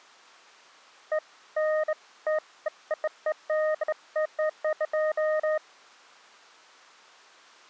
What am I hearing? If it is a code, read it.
Beeps of irregular length. There is no code.